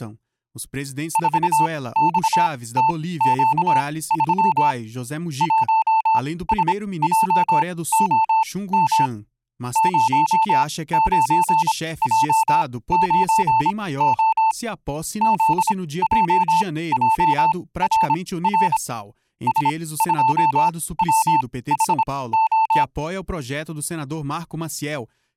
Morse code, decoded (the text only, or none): 4XTQ3 1SJOM 09J9O ZJJRR S2WHO